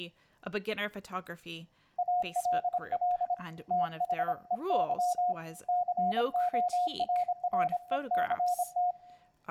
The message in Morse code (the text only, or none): ALL THEY CORRECT